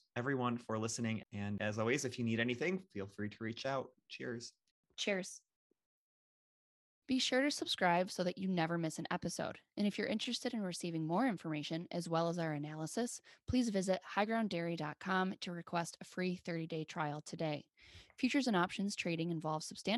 Speech in English. There is no code.